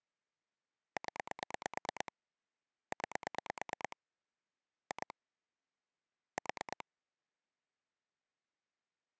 Pulse dialling, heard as clicks on a phone line, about 9 pulses a second. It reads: 0 9 2 4